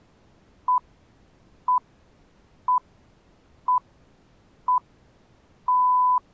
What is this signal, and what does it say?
Radio time signal (six pips, as the Greenwich Time Signal), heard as pips.